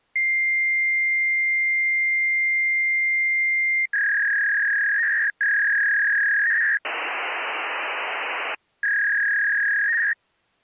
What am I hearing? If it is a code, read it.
Fax machine handshake, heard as a long tone, a warble and hiss.